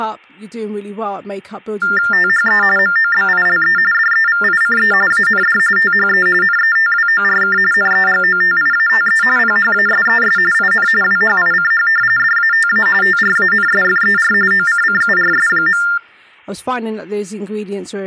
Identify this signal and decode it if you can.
TTY/TDD text telephone tones (45.45 baud Baudot), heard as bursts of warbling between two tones, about 400 Hz shift, 1600 Hz centre, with speech in English. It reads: THE MOBILE DEVICE AND THE NETWORK NEGOTIATE PHASES IN WHICH DATA TRANSFER OCCURS.